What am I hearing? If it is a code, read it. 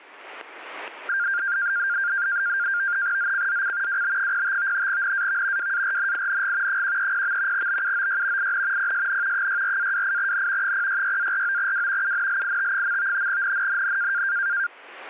NAVTEX (SITOR-B), 100 baud, 170 Hz shift, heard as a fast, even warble, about 1500 Hz centre, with static crashes. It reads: ZCZC WB05 NAV WARNING 130. BUOY IN PSN 64-28N 066-49W UNLIT. NNNN